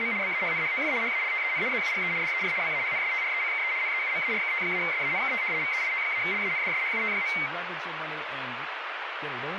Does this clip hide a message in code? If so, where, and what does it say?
Yes: RTTY (75 baud, 170 Hz shift) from 0.0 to 7.5 s, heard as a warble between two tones, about 2150 Hz centre, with radio static and speech in English. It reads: … BAHNHOF HALTEN ZUGE DER BAHNSTRECKE NEUMARKT-SANKT VEIT-LANDSHUT.